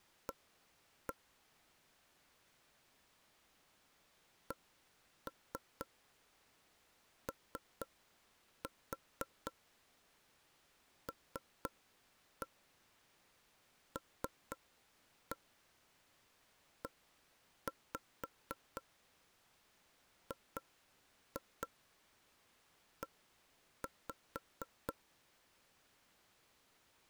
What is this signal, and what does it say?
Tap code, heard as taps on a table, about 4 knocks a second. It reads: A COLLEGE